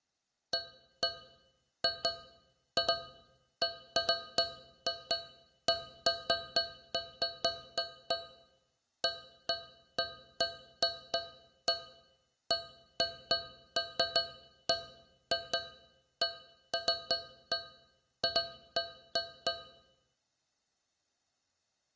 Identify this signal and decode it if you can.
Irregular taps on a metal pipe. There is no code.